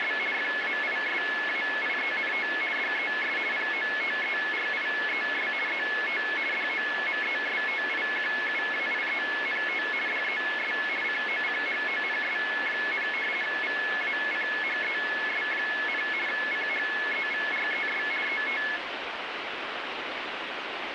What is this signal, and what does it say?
RTTY (50 baud, 450 Hz shift), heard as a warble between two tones, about 1950 Hz centre, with radio static. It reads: … FAISAIENT DES POTERIES ET DOMESTIQUAIENT DES COCHONS, VACHES, CHEVRES ET